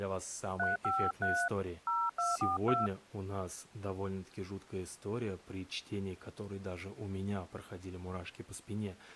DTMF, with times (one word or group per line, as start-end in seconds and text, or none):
0.6-1.5 353
1.9-2.9 0242